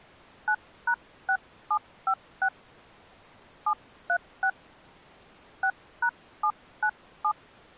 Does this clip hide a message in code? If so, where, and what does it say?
Yes: DTMF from 0.5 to 7.3 s, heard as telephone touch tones, dialled by hand, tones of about 70 ms. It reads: 9#6756 736 6#797